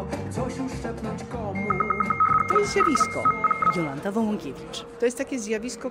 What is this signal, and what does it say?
RTTY (75 baud, 850 Hz shift), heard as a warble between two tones, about 1700 Hz centre, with a steady whistle near 470 Hz. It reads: URUOCA